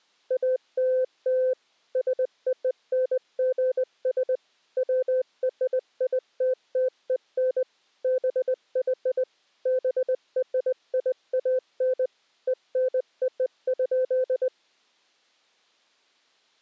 Morse code (American railroad code), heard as a keyed tone, machine-sent, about 510 Hz. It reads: ALL SONGS WRITTEN BY BRIAN ENO.